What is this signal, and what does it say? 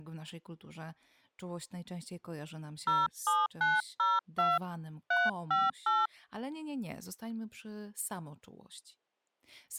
DTMF, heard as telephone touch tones, dialled by hand, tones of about 200 ms, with speech in Polish. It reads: 07902 358